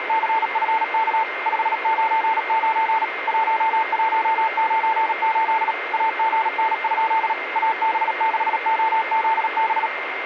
Morse code, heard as a keyed tone, machine-sent, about 37 wpm, 890 Hz, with radio static and a steady whistle near 2100 Hz. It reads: … 599 1198 AGN? AB6OZB